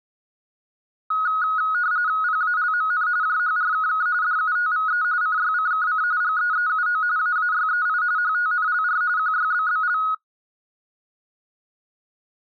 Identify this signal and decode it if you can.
RTTY (45.45 baud, 170 Hz shift), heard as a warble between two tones, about 1360 Hz centre. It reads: PALMN JHRKK DUTVE CYCKC GEEUO AAYEI HTNLR QYBBL